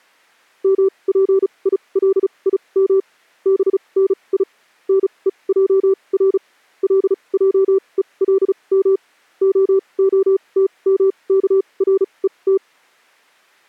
Morse code (Hebrew alphabet), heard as a keyed tone, machine-sent, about 35 wpm, spaced as for 26 wpm, 390 Hz. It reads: מפילים בני נוער לעולם ההתמכרות